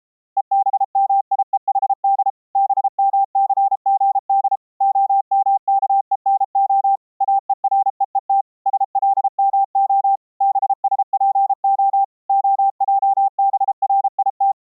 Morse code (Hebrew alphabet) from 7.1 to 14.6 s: אורוות שלמה בשפה העברית

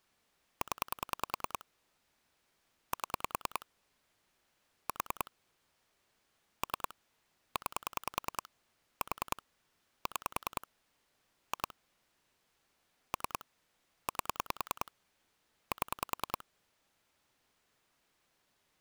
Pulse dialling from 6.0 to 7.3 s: 3

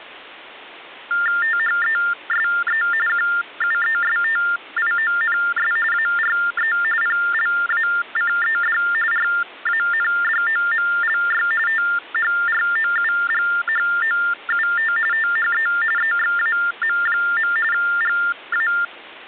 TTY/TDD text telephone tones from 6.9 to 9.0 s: PLACED

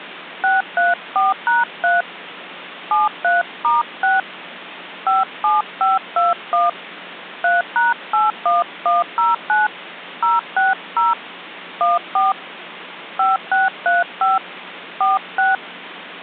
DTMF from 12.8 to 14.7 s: 5635

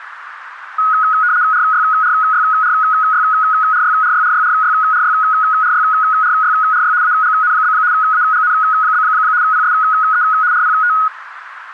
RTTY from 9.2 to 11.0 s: PSE RPT

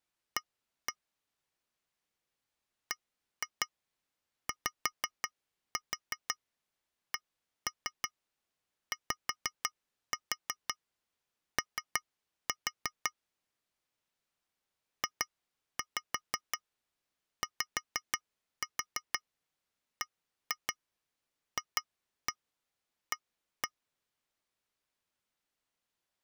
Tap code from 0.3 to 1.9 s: A

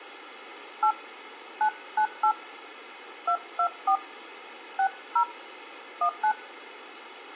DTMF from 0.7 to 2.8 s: 8 998

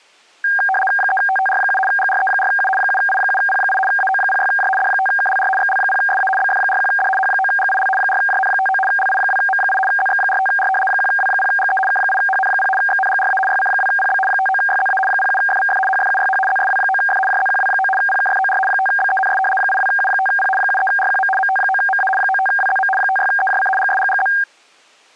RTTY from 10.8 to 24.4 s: 1W0GE K8HN0 XNGRA YC2PB 59YZA 07FVF HFUYH ZSW9F JZQW9 PKFOR 5BENS 82U5P 73RQM MT9MA 95WZM 56EJC GSGGZ

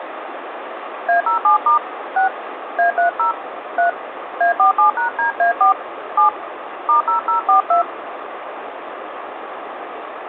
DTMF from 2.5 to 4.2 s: A30 3

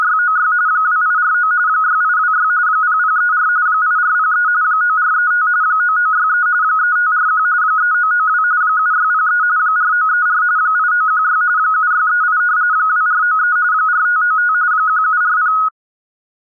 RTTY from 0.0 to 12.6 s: … 2849 6826 0034 8403 9435 9963 3541 3992 7603 4934 8916 7638

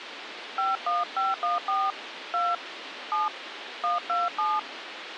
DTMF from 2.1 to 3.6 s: 2 7

